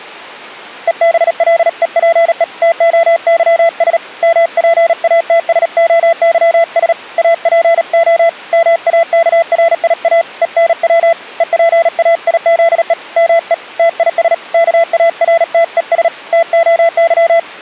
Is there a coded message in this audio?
Yes: Morse code (Greek alphabet) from 0.8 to 17.5 s, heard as a keyed tone, hand-sent with a paddle, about 37 wpm, 670 Hz. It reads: ΕΒΛΕΠΕ ΤΟΥΣ ΜΠΑΤΣΟΥΣ ΑΠΟ ΜΑΚΡΙΑ ΕΝΩ ΕΠΑΙΖΕ ΜΕ ΤΙΣ ΚΑΡΤΕΣ ΤΟΥ